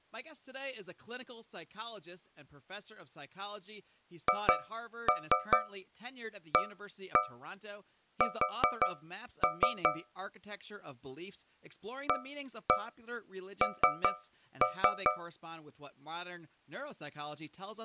Tap code, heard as taps on a metal pipe, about 5 knocks a second, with speech in English. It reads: HAS AN